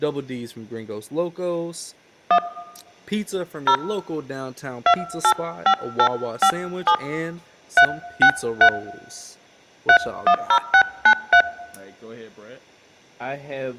DTMF, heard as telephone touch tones, dialled by hand, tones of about 80 ms, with speech in English. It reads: 1 0 285857 363 310693